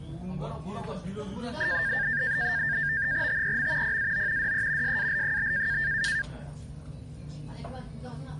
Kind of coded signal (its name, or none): NAVTEX (SITOR-B)